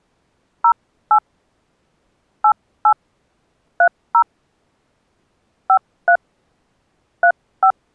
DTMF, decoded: 08 88 30 53 35

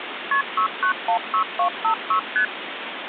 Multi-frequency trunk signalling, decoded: KP 6916256 ST

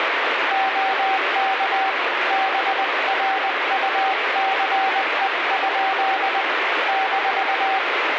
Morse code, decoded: OK BRUCE? -

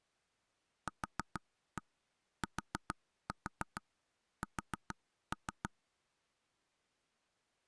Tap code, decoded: QTS

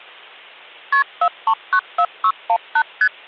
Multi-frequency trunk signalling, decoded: KP 4394618 ST

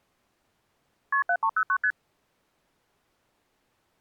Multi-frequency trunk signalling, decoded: KP 7309 ST

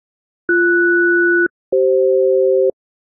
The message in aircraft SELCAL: BS-CF

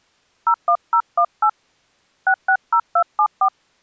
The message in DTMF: 01018 660274

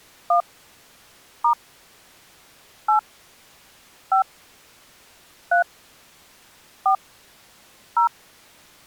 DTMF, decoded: 1 * 8 5 3 4 0

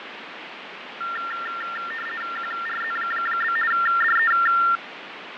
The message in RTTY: QRZ? DE

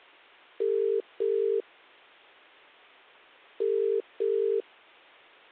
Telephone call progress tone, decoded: ringback tone

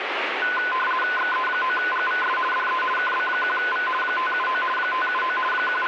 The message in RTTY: XE9GVS DE KB1V 579 579 …

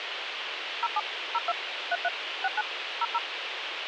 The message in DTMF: 07 02 33 69 00

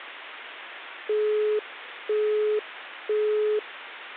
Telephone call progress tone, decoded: busy tone

